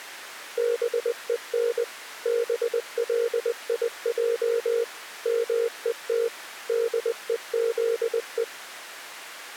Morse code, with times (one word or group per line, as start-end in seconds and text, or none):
0.6-1.8 BEN
2.3-4.8 BLIJ
5.3-6.3 MET
6.7-8.4 DEZE